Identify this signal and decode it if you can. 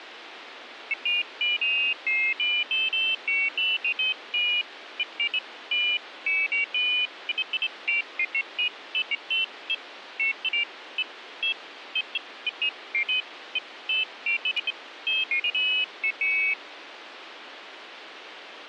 Pairs of high tones at irregular times, with radio hiss. There is no code.